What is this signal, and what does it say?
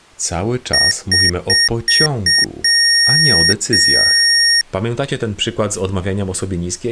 Beep code, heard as beeps from a small speaker, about 1850 Hz, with speech in Polish. 5 short, 2 long.